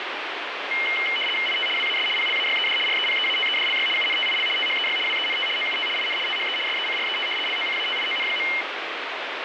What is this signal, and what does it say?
RTTY (75 baud, 850 Hz shift), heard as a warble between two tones, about 2550 Hz centre, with radio static. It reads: IT WAS PLAYED REPEATEDLY UNTIL THEY WENT OUT IN THE SECRET LOCATION.